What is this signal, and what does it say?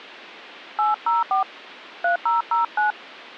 DTMF, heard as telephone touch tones, dialled by hand, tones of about 130 ms. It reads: 804 3009